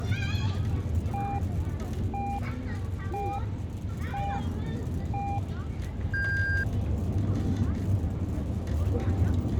Radio time signal (five pips and a higher one, as on Chinese radio), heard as pips, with the noise of a residential street.